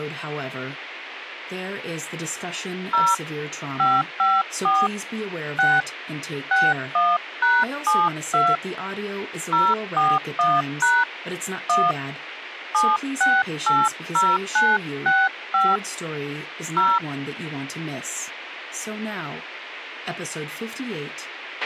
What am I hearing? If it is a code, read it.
DTMF, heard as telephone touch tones, dialled by hand, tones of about 220 ms, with a squelch burst at the end. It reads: 0 554 6 61#72 041# 1 7680965 0